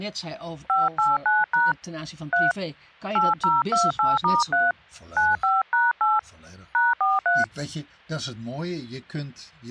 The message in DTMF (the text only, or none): 589# 3 8028*3 95#8 #43